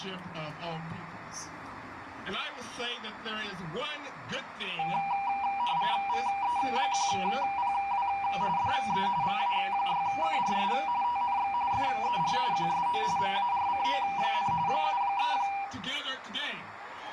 RTTY (45.45 baud, 170 Hz shift), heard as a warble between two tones, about 880 Hz centre, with radio static. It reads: VE1PW DE VA6KRS TNX FER QSO MARCO, 73